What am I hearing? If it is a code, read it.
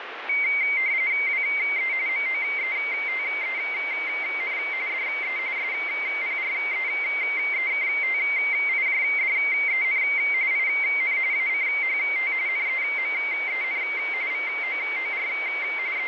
RTTY (45.45 baud, 170 Hz shift), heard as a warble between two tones, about 2150 Hz centre, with radio static. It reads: WE MOETEN DE SPREEKTIJDEN IN ACHT NEMEN VOOR …